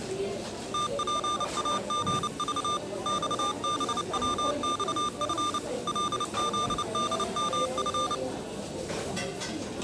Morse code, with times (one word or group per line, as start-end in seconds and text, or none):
0.7-2.8 TPAGV
3.1-5.6 XBWXF
5.9-8.1 LZDMF